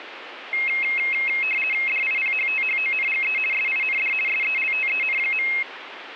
RTTY (50 baud, 450 Hz shift), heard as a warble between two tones, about 2350 Hz centre, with radio static. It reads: DIPHTHONGE SIND SELTEN.